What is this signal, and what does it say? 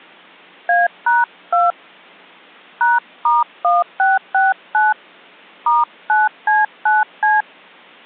DTMF, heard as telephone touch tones, dialled by hand, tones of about 180 ms. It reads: A#2 #*1669 *9C9C